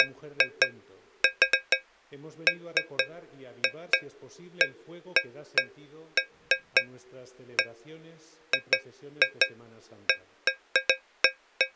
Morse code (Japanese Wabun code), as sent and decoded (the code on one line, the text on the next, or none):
none